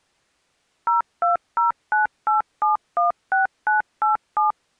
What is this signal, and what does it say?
DTMF, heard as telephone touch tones, dialled by machine, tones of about 140 ms. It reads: 02098716987